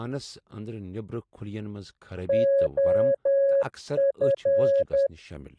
Morse code, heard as a keyed tone, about 10 wpm, 550 Hz, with speech in Kashmiri. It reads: OF